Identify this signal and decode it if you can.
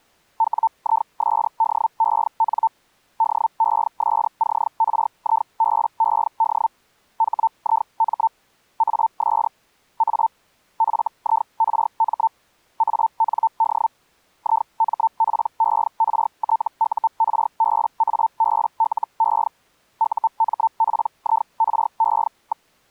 Hellschreiber (Feld-Hell, 122.5 baud), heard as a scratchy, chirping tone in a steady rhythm, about 900 Hz. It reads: WISDEN DESCRIBED HIM AS A FIRM AND IMPERTURBABLE UMPIRE.